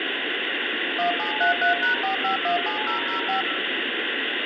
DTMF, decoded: 1733#4517005

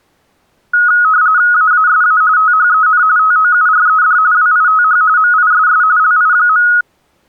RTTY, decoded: AASA THEN TOURED WITH MISS LI.

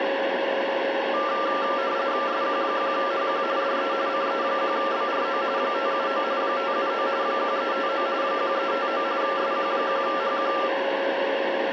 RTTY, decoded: SQ1HQ DE CE1BRO 579 579 1359 1359 SQ1HQ

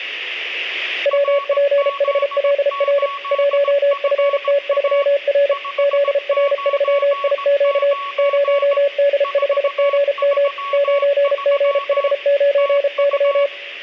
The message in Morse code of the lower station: WPHLR 1FT3R ZR3IQ 0D5GM 9GH9Y

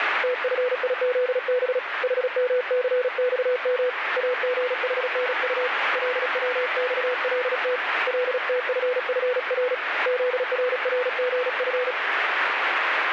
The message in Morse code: TFIZB HMCXM AGHNU LWXLT LTFFR ZRRGF

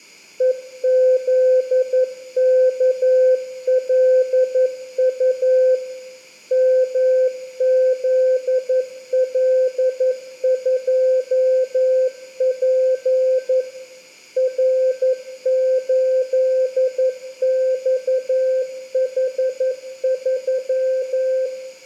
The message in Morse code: EZKLU MZL2P R8XH3

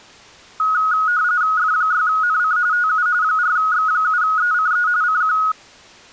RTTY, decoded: F6NC TU 4X7ECE CQ

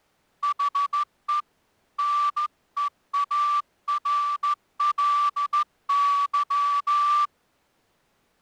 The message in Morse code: HE NEARLY

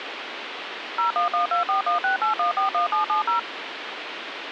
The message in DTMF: 01124168141770

